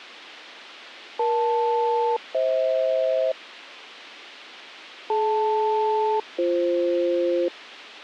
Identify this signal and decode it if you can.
Aircraft SELCAL, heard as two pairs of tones. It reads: EL-FH DL-BF